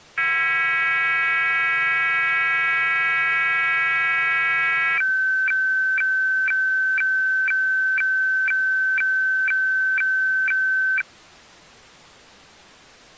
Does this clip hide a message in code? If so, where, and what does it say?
Yes: weather fax (radiofax), 120 lines a minute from 0.2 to 11.0 s, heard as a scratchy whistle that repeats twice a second.